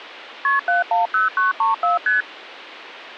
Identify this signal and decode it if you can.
Multi-frequency trunk signalling (R1, as on North American trunks), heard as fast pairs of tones, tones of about 150 ms. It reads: KP 710934 ST